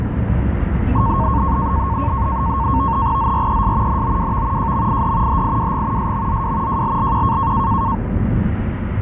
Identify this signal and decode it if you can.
NAVTEX (SITOR-B), 100 baud, 170 Hz shift, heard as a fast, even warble, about 1000 Hz centre, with radio static, a steady whistle near 350 Hz and the noise inside a car. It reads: ZRES NOWV JMID HIWG SMZW JLLQ